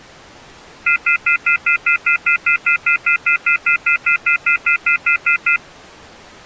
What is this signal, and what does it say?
Telephone call progress tone (North American plan), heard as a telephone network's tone, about 1400, 2050, 2450, 2600 Hz, 0.1 s on and 0.1 s off. Off-hook warning tone.